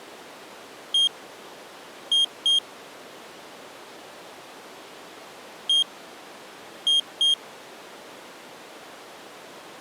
Beep code, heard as a piezo beeper, played twice, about 3200 Hz. 1-2.